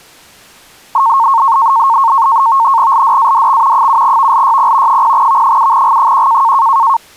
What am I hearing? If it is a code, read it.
NAVTEX (SITOR-B), 100 baud, 170 Hz shift, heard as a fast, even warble, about 1000 Hz centre. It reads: LDADX 7VLYP 0V7G1